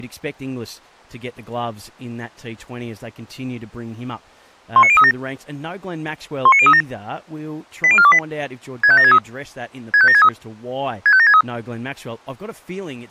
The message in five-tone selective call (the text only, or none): 19037 19037 80428 65763 65763 65763